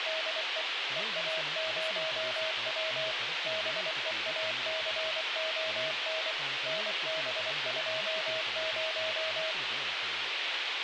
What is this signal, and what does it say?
Morse code, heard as a keyed tone, machine-sent, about 24 wpm, 640 Hz, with radio hiss and speech in Tamil. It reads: DE EA0W BEACON NB20